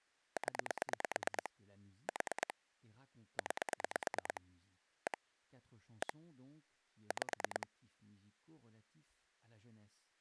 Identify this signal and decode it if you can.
Pulse dialling, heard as clicks on a phone line, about 9 pulses a second, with speech in French. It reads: 0 4 9 1 1 5